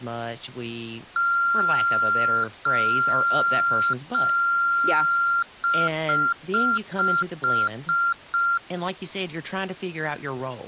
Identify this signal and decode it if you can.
Beep code, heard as beeps from a small speaker, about 1380 Hz, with speech in English. 3 long, 7 short.